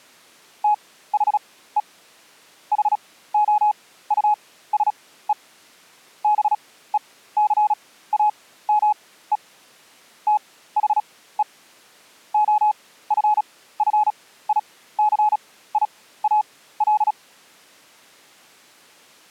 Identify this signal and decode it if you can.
Morse code, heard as a keyed tone, machine-sent, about 36 wpm, spaced as for 17 wpm, 840 Hz. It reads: THE HOUSE BECAME THE OFFICIAL